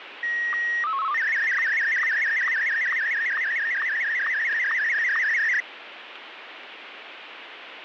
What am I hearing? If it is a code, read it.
SSTV (slow-scan television), Martin M1, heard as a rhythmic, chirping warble, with radio static.